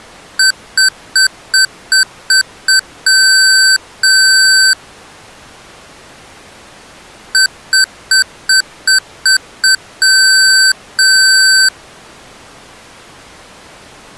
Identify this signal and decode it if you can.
Beep code, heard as beeps from a small speaker, played twice, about 1550 Hz. 7 short, 2 long.